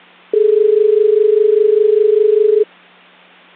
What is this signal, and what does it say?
Telephone call progress tone (as in Australia), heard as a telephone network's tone, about 430 Hz. Dial tone.